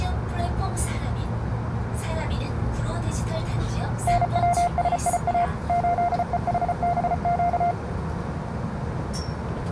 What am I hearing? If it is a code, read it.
Morse code, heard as a keyed tone, machine-sent, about 34 wpm, 700 Hz, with radio static and the noise inside a subway train. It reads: NWSIA 8EHBQ